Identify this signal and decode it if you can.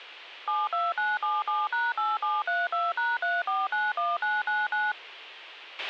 DTMF, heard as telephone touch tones, dialled by machine, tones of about 200 ms, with a squelch burst at the end. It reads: 72977#8732#3491999